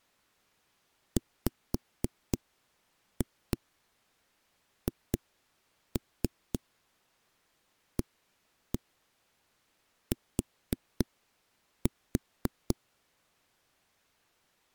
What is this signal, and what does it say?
Tap code, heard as knocks on a wall, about 3 knocks a second. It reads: WHAT